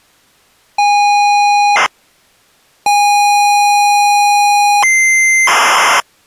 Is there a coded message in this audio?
Yes: ZX Spectrum tape loading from 0.8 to 6.0 s, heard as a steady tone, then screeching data.